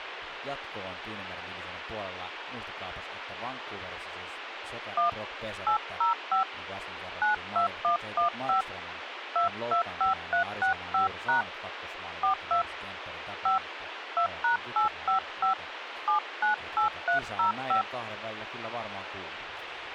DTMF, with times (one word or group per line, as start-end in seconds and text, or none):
5.0-5.1 1
5.7-6.4 805
7.2-8.6 92115
9.4-11.4 225365#
12.2-12.6 42
13.5-13.6 5
14.2-15.5 2#855
16.1-17.8 798305